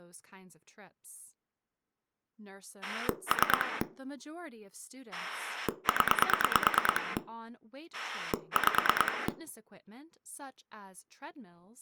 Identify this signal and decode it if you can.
Pulse dialling, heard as a rotary dial, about 9 pulses a second, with speech in English. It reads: 3 0 5